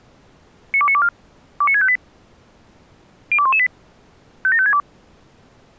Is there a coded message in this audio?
Yes: five-tone selective call (ZVEI) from 0.7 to 4.8 s, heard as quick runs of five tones, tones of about 70 ms. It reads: 92924 29658 02118 57562